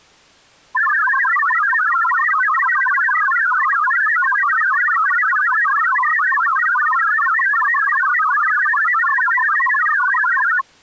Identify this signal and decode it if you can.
Multi-tone FSK (Olivia or MFSK type), about 1000 Hz wide, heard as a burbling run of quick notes, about 62.5 baud.